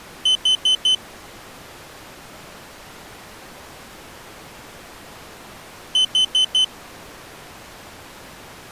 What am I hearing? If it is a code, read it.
Alarm pattern, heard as an alarm's beeps, played twice, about 3050 Hz. Temporal four. Carbon monoxide.